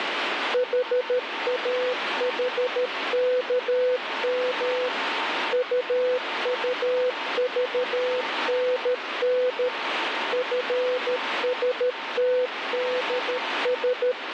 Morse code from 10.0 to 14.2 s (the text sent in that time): FSTDS